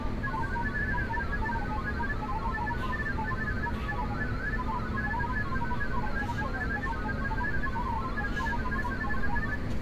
Multi-tone FSK (Olivia or MFSK type), about 1000 Hz wide, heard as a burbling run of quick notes, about 31.25 baud, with room echo and street noise.